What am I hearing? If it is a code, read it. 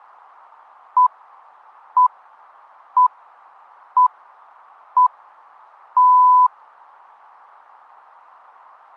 Radio time signal (six pips, as the Greenwich Time Signal), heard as pips.